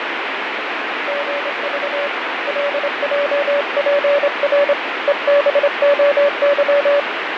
Morse code, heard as a keyed tone, hand-sent with a straight key, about 26 wpm, 570 Hz, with heavy radio static and fading. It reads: GV LJPR EBOY